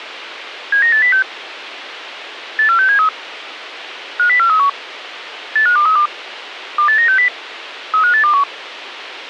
Five-tone selective call (CCIR), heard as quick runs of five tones, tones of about 100 ms, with radio hiss. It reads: 79806 84673 50431 85232 28960 35821